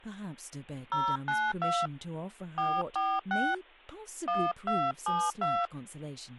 DTMF, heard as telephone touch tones, dialled by hand, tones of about 240 ms, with speech in English. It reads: 092 446 1272